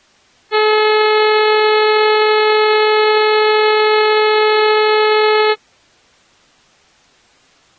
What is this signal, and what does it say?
Ship horn signal, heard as a ship's horn, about 430 Hz. 1 long. At sea: a vessel nearing a blind bend, or under power and making way in fog.